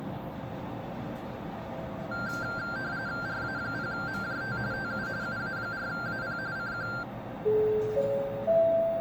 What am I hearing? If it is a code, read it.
RTTY (45.45 baud, 170 Hz shift), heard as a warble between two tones, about 1480 Hz centre, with the noise inside a lift. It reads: RA0MJT TU UA4AP CQ